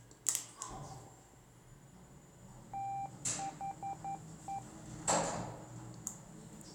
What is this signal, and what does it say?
Morse code, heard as a keyed tone, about 11 wpm, 790 Hz, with the noise inside a lift. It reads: THE